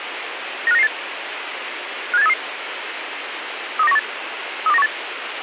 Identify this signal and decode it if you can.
Five-tone selective call (EEA), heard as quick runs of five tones, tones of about 40 ms, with radio hiss. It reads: 95998 57833 32918 32918